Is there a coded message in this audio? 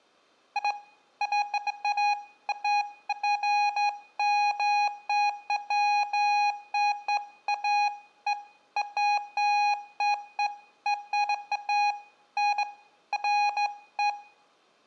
No, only beeps of irregular length, with room echo.